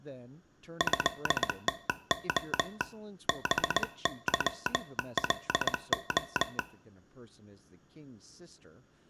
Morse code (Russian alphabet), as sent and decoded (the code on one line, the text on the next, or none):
..-.. - --- / -... -.-- .-.. ---
ЭТО БЫЛО